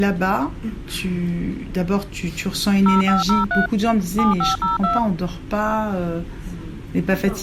DTMF, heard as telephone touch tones, dialled by machine, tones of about 150 ms. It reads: 0503 7502